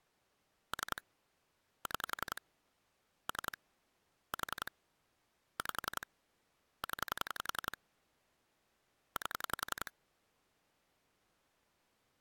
Pulse dialling, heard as clicks on a phone line, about 11 pulses a second. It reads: 3 6 3 4 5 0 8